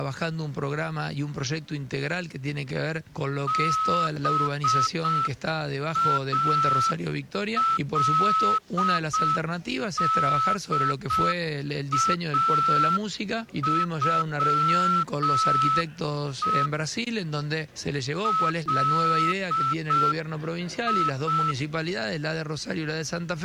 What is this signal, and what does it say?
Morse code (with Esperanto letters), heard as a whistle, hand-sent with a straight key, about 6 wpm. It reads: BALDAŬE LI